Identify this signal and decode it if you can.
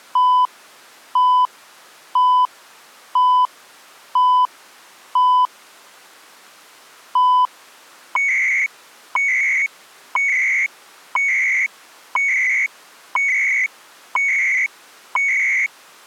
Radio time signal (CHU, Canada), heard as beeps and data bursts, one a second.